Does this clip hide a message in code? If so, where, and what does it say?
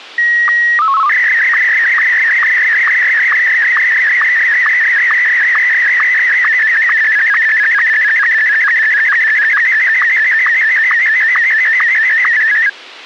Yes: SSTV (slow-scan television), Martin M1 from 0.2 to 12.7 s, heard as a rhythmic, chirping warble.